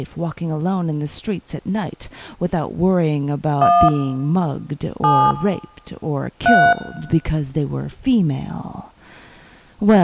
DTMF, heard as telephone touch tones, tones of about 270 ms, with room echo. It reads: 1 7 3